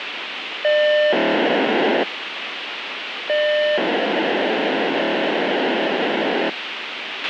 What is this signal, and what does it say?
POCSAG pager data (1200 baud), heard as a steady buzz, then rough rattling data, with radio hiss and a squelch burst at the end.